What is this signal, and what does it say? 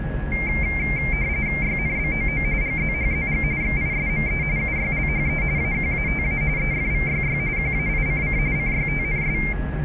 RTTY (45.45 baud, 170 Hz shift), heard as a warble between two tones, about 2200 Hz centre, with a steady whistle near 1670 Hz and the noise inside a lift. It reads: YNBOO GZHZG XISME UYLHE AQATA EFVYY QAICC CYTNS